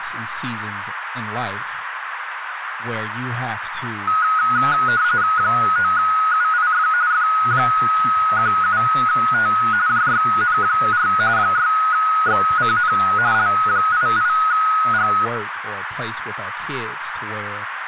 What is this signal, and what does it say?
RTTY (45.45 baud, 170 Hz shift), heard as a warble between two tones, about 1360 Hz centre, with radio static, a narrow filter and speech in English. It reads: 9UIF F17T JYN4 6XCN L88G